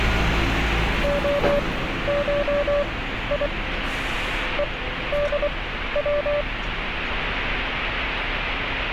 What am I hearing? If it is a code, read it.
Morse code (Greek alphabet), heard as a keyed tone, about 24 wpm, spaced as for 13 wpm, 580 Hz, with radio static and street noise. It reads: ΟΧΙ ΕΔΩ